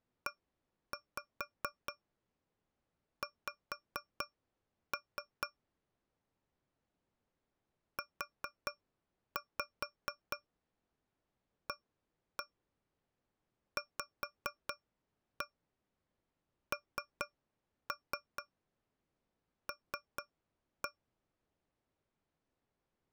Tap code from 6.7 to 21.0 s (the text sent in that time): UAVNL